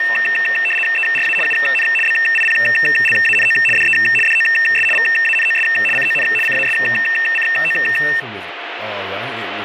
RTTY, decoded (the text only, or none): ERA UN BIPLANO DE DOS VANOS CON CASCO